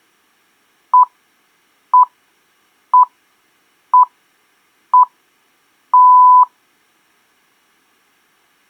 Radio time signal (six pips, as the Greenwich Time Signal), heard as pips.